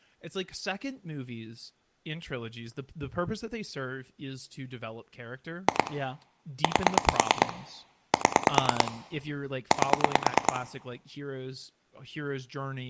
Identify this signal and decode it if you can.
Pulse dialling, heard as clicks on a phone line, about 9 pulses a second, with room echo and speech in English. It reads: 2 8 7 8